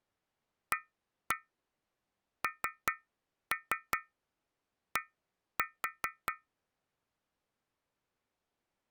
Tap code, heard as taps on a metal pipe, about 5 knocks a second. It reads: AND